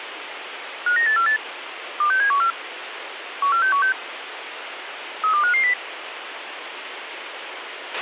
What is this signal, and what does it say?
Five-tone selective call (CCIR), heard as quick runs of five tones, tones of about 100 ms, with radio hiss and a squelch burst at the end. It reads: 59848 26714 14616 32550